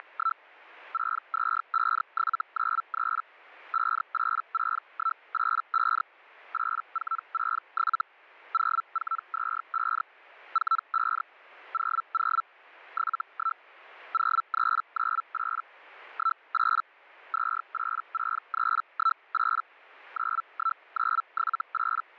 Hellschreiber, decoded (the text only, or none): … 625793 586185 8467 0425 45 00 71 0398 18 286318 91978